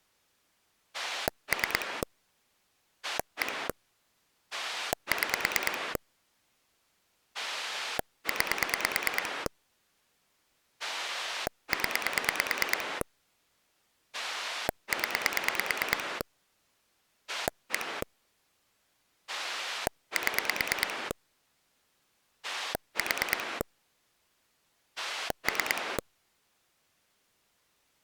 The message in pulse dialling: 3 1 6 9 0 0 1 7 4 3

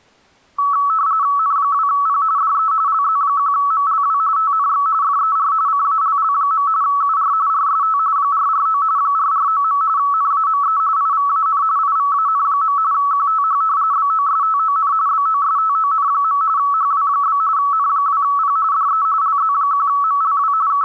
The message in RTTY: N2P DE LZ1MLW TNX FER CALL. UR RST 449 449. NAME IVAN IVAN. QTH BOSTON BOSTON. HW? N2P DE LZ1MLW …

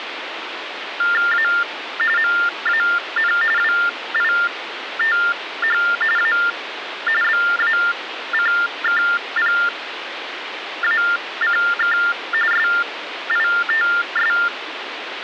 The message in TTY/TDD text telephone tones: A MAN WITH A BACKPACK SITS

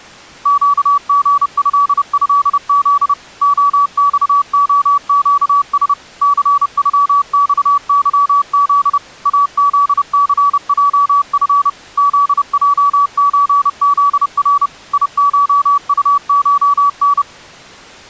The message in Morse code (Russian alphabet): ЩГЭЭЗ ОЬОЩС ЦЮЬЫЗ АЗЦЙФ ЗЙЧЗР ИШУШН

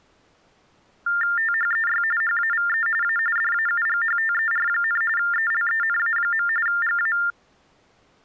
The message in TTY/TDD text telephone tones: THEY HAVE A DAUGHTER, ELENA. GA

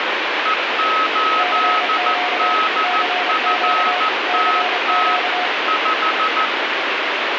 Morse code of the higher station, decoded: E8DFTT 5

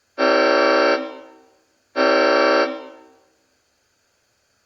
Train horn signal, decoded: 2 short

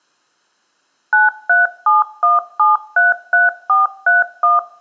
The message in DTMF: 9371733431

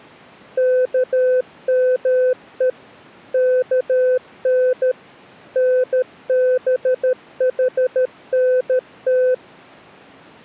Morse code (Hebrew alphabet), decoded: כמו כן נבחנת

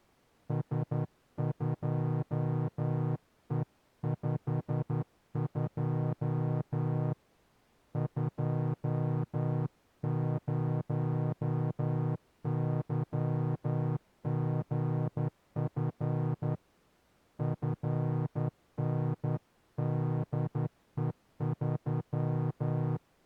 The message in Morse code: S2E52 20YGF FNDE3

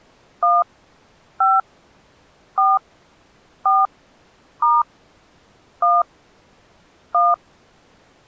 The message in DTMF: 1 5 4 4 * 1 1

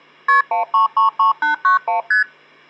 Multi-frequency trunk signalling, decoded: KP 1333891 ST

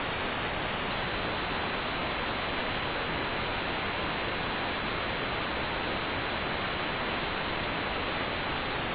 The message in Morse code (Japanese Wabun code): none

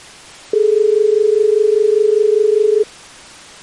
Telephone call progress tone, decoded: dial tone

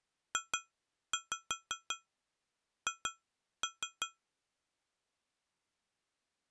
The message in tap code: JH

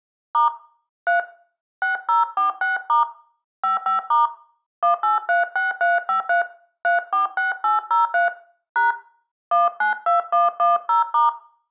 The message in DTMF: * 3 6046* 55* 1836353 346803 # 192110*

